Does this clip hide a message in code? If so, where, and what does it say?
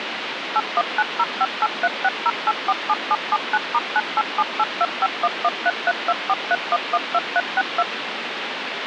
Yes: DTMF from 0.6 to 7.8 s, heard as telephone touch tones, dialled by machine, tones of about 40 ms, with phone line noise. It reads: 819058360847779*9878251133243112362